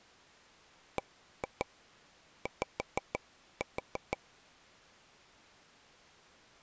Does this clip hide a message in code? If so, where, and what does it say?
Yes: tap code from 1.0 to 4.2 s, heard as taps on a table, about 6 knocks a second. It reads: BY